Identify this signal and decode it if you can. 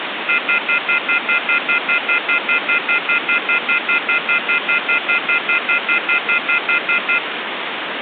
Telephone call progress tone (North American plan), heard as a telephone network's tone, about 1400, 2050, 2450, 2600 Hz, 0.1 s on and 0.1 s off, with phone line noise. Off-hook warning tone.